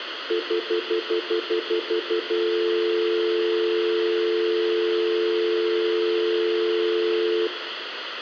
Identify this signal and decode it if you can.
Telephone call progress tone (North American plan), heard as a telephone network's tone, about 350, 440 Hz, 0.1 s on and 0.1 s off, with phone line noise and room echo. Stutter dial tone.